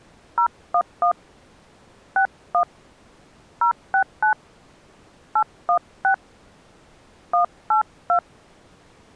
DTMF, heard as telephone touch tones, dialled by hand, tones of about 90 ms. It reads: 011 61 069 816 182